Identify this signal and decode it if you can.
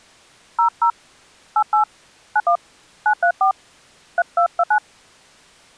DTMF, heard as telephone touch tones, dialled by hand, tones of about 80 ms. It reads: 00 88 91 934 3229